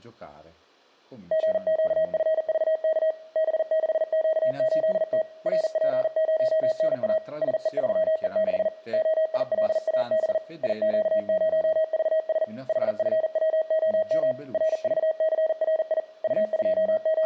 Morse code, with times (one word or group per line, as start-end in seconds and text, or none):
1.3-3.1 GQFVK
3.4-5.2 B6Q8T
5.5-7.2 RP0NA
7.4-8.7 SE3E6
8.9-10.4 OILAB
10.6-12.4 IQ0VS
12.7-14.3 HFWOM
14.5-16.0 RVCRI
16.2-17.3 …